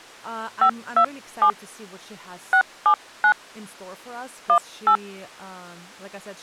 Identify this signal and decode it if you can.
DTMF, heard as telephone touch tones, dialled by hand, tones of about 80 ms, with speech in English. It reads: 527 679 18